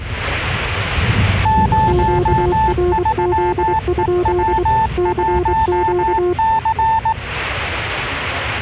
Morse code, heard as two keyed tones, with the noise inside a bus. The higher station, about 18 wpm, 880 Hz: 03EW1C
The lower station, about 24 wpm, 360 Hz: QRZ? CQ